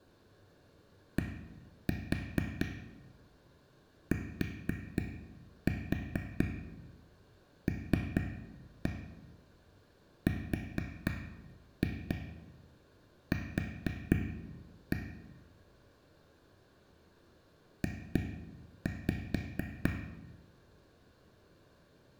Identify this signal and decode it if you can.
Tap code, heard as taps on a table, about 4 knocks a second, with room echo. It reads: DTLRQ J